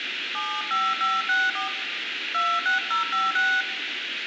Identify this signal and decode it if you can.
DTMF, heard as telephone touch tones, dialled by hand, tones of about 230 ms, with phone line noise and room echo. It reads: 75564 26056